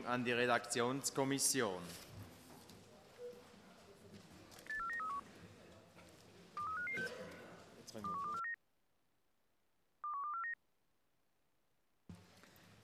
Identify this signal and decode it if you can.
Five-tone selective call (CCIR), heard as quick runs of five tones, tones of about 100 ms. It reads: 84931 23556 21249 21249